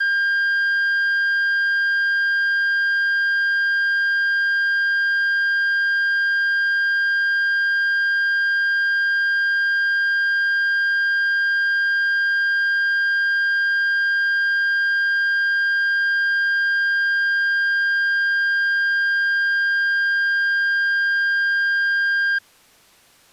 A steady tone. There is no code.